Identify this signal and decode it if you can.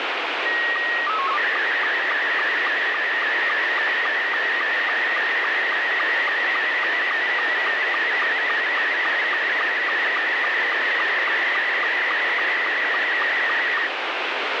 SSTV (slow-scan television), Scottie S2, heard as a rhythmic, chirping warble, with heavy radio static.